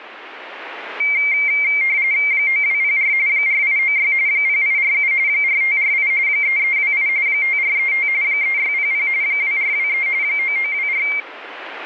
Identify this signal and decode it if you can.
RTTY (45.45 baud, 170 Hz shift), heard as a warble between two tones, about 2200 Hz centre, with radio static. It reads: 9204 4896 0847 4548 3328 5435 3600 2423 9924